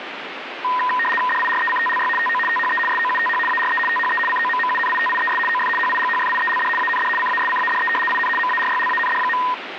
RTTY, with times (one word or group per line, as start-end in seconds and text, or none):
1.3-2.1 DIRECTLY
2.2-2.4 TO
2.5-2.8 THE
2.9-3.4 SOUTH
3.5-3.8 ARE
3.9-4.2 THE
4.3-5.4 COMMUNITIES
5.5-5.7 OF
5.8-6.7 HIGHFIELD
6.8-7.1 AND
7.2-7.9 CASCADE
8.1-8.3 IN
8.4-9.4 MARYLAND.